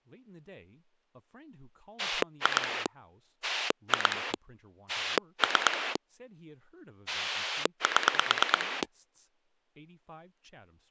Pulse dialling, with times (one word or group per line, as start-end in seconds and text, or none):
2.0-2.9 2
3.4-4.3 2
4.9-6.0 3
7.1-8.8 7